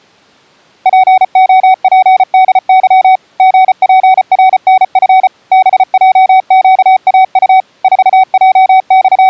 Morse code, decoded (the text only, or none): POPDY GPRNF BJQAU …